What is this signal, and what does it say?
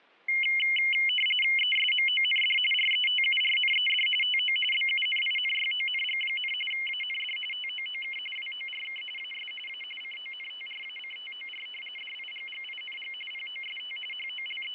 RTTY (45.45 baud, 850 Hz shift), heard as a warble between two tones, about 2550 Hz centre, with fading. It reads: ESMOND RETURNED TO BUNINYONG, AND TOOK WORK AS A CONTRACTOR DIGGING POST …